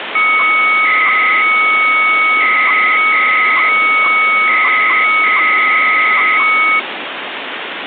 300-baud modem data (Bell 103 tones), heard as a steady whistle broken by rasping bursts, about 300 baud, 200 Hz shift, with phone line noise.